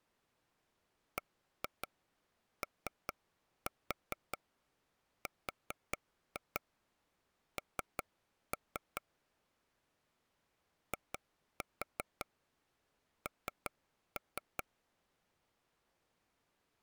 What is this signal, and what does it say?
Tap code, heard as taps on a table, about 5 knocks a second. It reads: BORN IN